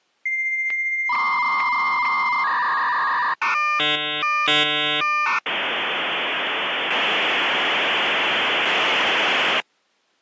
Dial-up modem handshake (V.34 or later), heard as a whistle, warbles, then hiss.